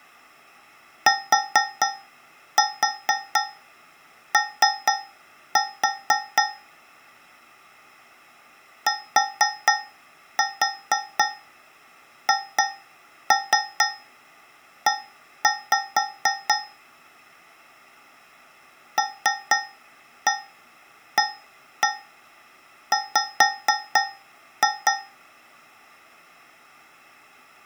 Tap code, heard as taps on a metal pipe, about 4 knocks a second. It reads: TO THE LAW